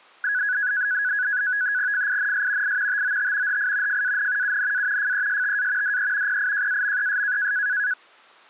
NAVTEX (SITOR-B), 100 baud, 170 Hz shift, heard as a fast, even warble, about 1600 Hz centre. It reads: FINS I TOT HI FAN UNA FESTA DE PIJAMES